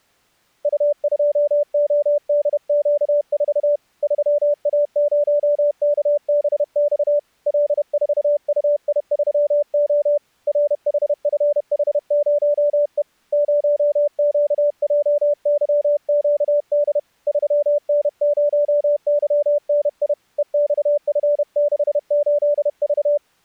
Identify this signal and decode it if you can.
Morse code, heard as a keyed tone, hand-sent with a paddle, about 31 wpm, 580 Hz. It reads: U2ODQ4 3A0KBX L4UI3O RHFH0E 0QJYQD 3N0YNI EXF68V